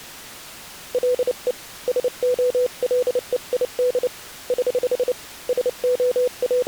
Morse code, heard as a keyed tone, hand-sent with a paddle, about 29 wpm, 500 Hz. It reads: LE SOLEID <HH> …